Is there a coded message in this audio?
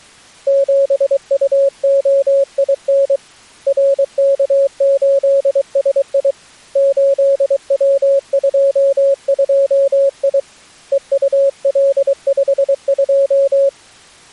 Yes: Morse code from 0.4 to 13.7 s, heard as a keyed tone, hand-sent with a paddle, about 23 wpm, 550 Hz. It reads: 7UOIN RK8SI 8W22I EUL52